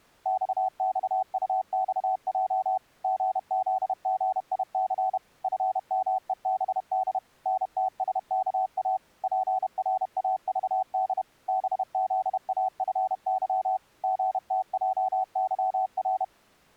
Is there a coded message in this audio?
Yes: Morse code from 0.2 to 16.3 s, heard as a keyed tone, machine-sent, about 31 wpm, 760 Hz. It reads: XXUXJ GZGIC FMEBD NTSKA PRAVD BZAFY GTJYR